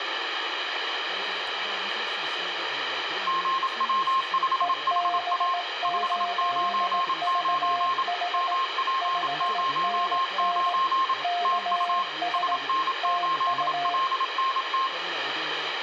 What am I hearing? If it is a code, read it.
Morse code, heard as two keyed tones, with radio static, room echo and speech in Korean. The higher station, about 27 wpm, 1060 Hz: GW5HA 599 MP09 TU SN8LNT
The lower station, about 18 wpm, 700 Hz: EB8VH 5NN KS TU